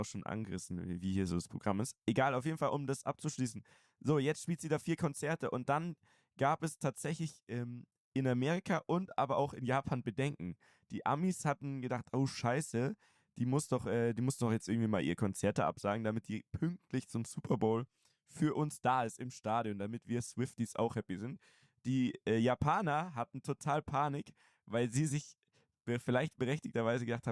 Speech in German. There is no code.